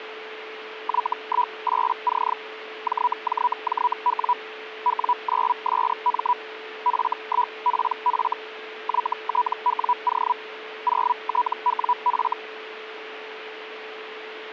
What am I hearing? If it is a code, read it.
Hellschreiber (Feld-Hell, 122.5 baud), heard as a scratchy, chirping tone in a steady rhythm, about 980 Hz, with radio static and a steady whistle near 440 Hz. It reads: Y18C JJJW W9SM F1PF YTWO 0TWF